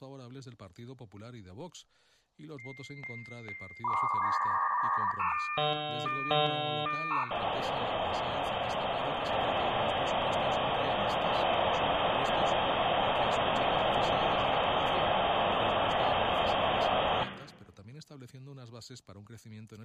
Dial-up modem handshake (V.34 or later), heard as a whistle, warbles, then hiss, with room echo and speech in Spanish.